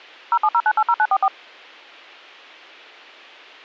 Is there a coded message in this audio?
Yes: DTMF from 0.3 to 1.3 s, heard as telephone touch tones, dialled by machine, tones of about 60 ms. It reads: 070980944